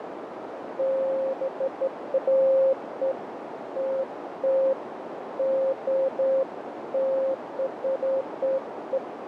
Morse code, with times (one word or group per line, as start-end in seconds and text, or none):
none